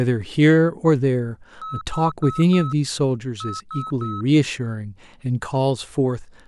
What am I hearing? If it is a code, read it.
Beep code, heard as beeps, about 1290 Hz, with speech in English. 4-3.